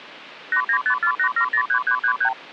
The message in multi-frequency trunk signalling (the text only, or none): 89548703333